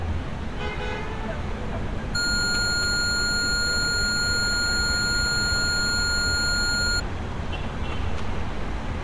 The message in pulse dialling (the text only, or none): none